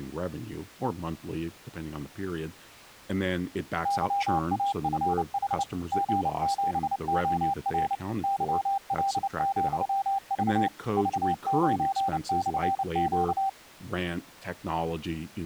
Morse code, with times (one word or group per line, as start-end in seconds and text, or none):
3.9-5.6 YAFH
5.9-7.9 G7OR
8.2-10.7 YL,V
11.0-13.5 V9/Q